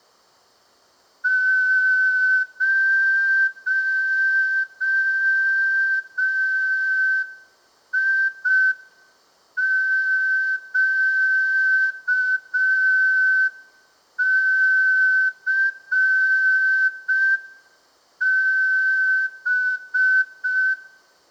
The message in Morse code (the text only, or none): 0IQCB